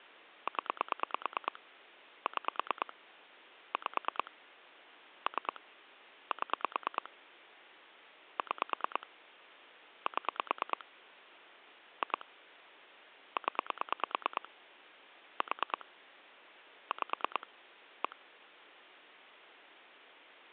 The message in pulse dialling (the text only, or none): 0 6 5 3 7 6 7 2 0 4 5 1